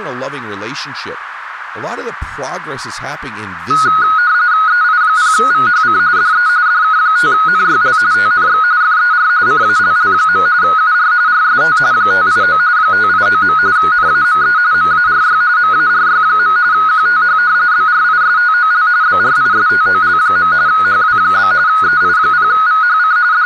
RTTY (45.45 baud, 170 Hz shift), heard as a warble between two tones, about 1360 Hz centre, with radio static, a narrow filter and speech in English. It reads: EI0VHC DE DK5NYL TNX FER CALL. UR RST 589 589. NAME MARY MARY. QTH BRISTOL BRISTOL. HW? EI0VHC …